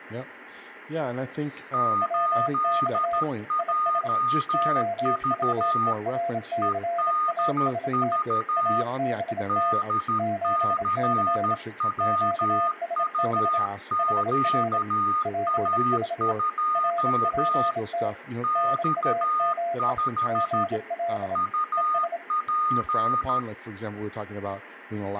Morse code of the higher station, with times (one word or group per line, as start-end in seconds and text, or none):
1.7-5.9 8JV
6.6-8.8 EDV
9.5-17.7 DCWUQA2
18.4-20.6 X5
21.4-23.4 UP